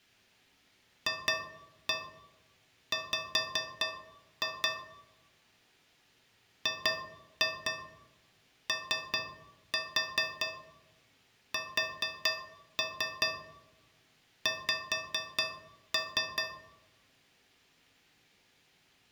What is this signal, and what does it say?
Tap code, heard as taps on a metal pipe, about 4 knocks a second, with room echo. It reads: FW GOSX